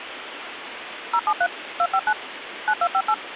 DTMF, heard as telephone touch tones, dialled by machine, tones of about 60 ms, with phone line noise. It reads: 073 259 9258